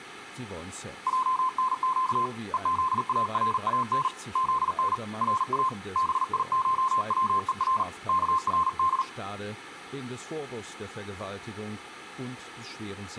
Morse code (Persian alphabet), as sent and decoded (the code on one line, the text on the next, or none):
.--- -. --.- / . --.. .- .-. .- -. / --.. -. / .-. .- / -... .. ---- .-- . .-. / -.- .-. -..
جنگ هزاران زن را بیشوهر کرد